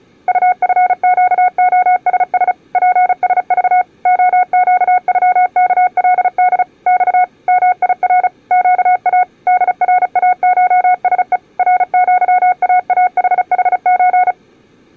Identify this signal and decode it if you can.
Morse code (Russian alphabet), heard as a keyed tone, machine-sent, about 35 wpm, 730 Hz. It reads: УФЩОСС ПСЖ ОЩЮКЛД Ь МИР ЩА ДРАШСЕ РЪААХХЧ